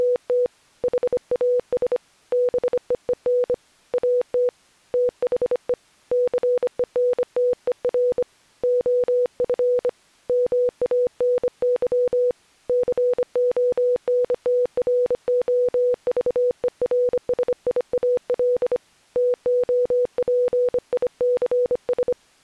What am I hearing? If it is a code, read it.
Morse code, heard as a keyed tone, hand-sent with a bug key, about 25 wpm, 490 Hz. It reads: … HAS BEEN AT THE CENTER OF MANY CONTROVERSIAL TOPICS